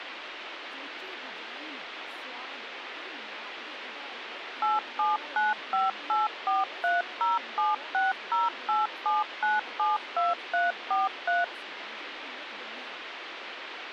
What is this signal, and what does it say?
DTMF, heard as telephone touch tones, dialled by machine, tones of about 170 ms, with phone line noise and speech in Dogri. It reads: 8795843076087972343